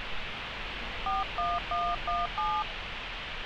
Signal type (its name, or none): DTMF